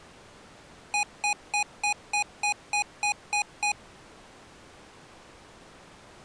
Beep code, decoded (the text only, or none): 10 short